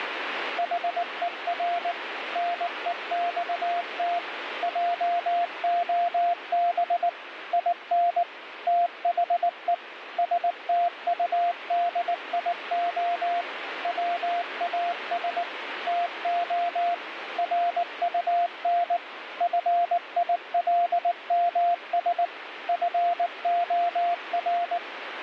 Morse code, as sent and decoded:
.... . .-. / -. . -..- - / .--- --- -... / .. -. / - .... . / ... - ..- -.. .. --- / .-- .- ... / - --- / .-. ..- -. / ..-. .. .-.. -- ... / ..-. --- .-.
HER NEXT JOB IN THE STUDIO WAS TO RUN FILMS FOR

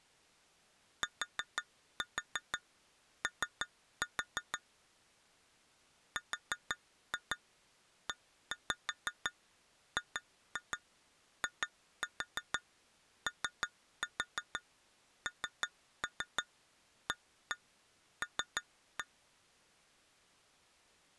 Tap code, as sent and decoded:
4-4 3-4 / 4-2 1-5 2-2 2-4 3-4 3-3 1-1 3-1
TO REGIONAL

